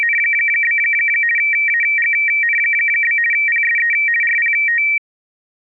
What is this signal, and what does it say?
RTTY (50 baud, 450 Hz shift), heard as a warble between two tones, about 2100 Hz centre. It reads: … AGN? PSE RPT